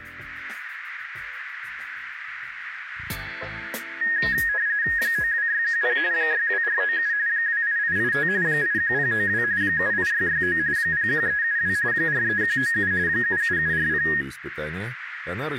RTTY (45.45 baud, 170 Hz shift), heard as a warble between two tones, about 1750 Hz centre, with radio static. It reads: 92610 62497 28885 81092 78669 01372 43197 77740